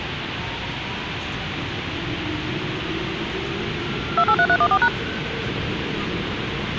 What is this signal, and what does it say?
DTMF, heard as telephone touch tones, dialled by machine, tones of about 60 ms, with radio hiss, a squelch burst at the end and the noise inside a subway train. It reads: 283314#